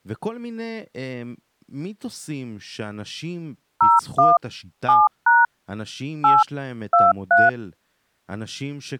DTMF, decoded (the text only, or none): 01 7# 8 23